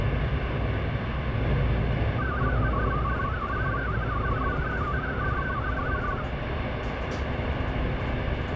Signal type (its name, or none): multi-tone FSK (Olivia or MFSK type)